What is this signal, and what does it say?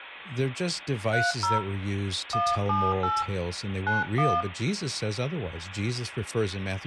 DTMF, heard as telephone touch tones, dialled by hand, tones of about 210 ms, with phone line noise and speech in English. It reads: 30 178 91